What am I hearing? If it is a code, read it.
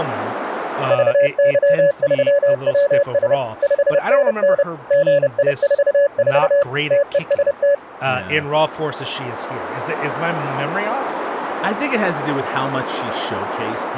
Morse code, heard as a keyed tone, machine-sent, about 30 wpm, 570 Hz, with speech in English. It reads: VY3WS 5NN GI44 TEST